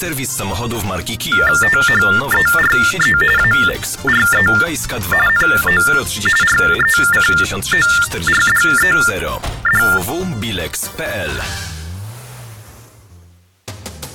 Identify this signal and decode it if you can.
TTY/TDD text telephone tones (45.45 baud Baudot), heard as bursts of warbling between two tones, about 400 Hz shift, 1600 Hz centre. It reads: THERE ARE NO RECORDED